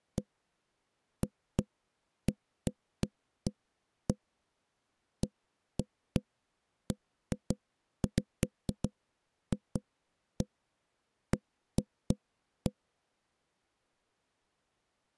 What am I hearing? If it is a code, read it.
Irregular knocks on wood. There is no code.